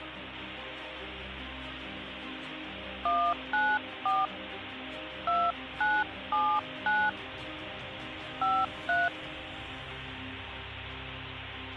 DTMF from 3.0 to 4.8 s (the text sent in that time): 194